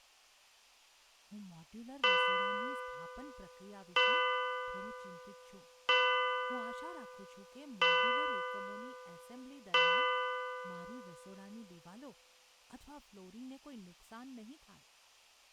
Clock strike, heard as a bell, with room echo and speech in Gujarati. 5. Five o'clock.